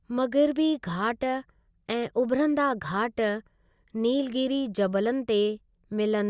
Speech in Sindhi. There is no code.